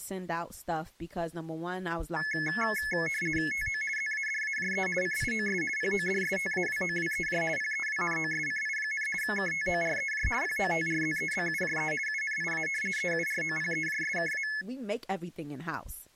RTTY (50 baud, 450 Hz shift), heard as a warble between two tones, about 1950 Hz centre, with speech in English. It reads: TO ZADAJE CIOS PODSTAWOWEJ PEWNOSCI, KTOREJ POTRZEBUJE UNIA EUROPEJSKA